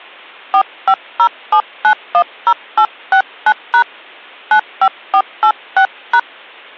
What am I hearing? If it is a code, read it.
DTMF, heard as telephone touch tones, dialled by hand, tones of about 70 ms. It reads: 4507910869# 95486#